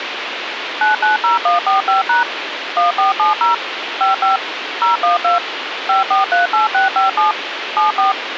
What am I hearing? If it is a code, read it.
DTMF, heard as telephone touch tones, dialled by machine, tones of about 140 ms, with radio hiss. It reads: 990145# 1470 55 012 5438657 74